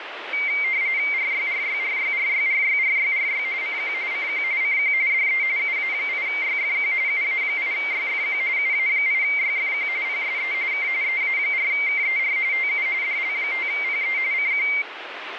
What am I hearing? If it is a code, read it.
RTTY (45.45 baud, 170 Hz shift), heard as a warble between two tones, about 2200 Hz centre, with radio static. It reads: RYRYRYRYRYRYRY CQ CQ CQ DE UA8YFQ UA8YFQ UA8YFQ PSE K EA4KER TU DL5PE CQ